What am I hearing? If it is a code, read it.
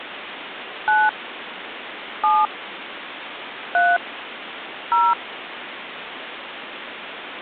DTMF, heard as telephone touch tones, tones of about 220 ms, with phone line noise. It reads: 9 7 3 0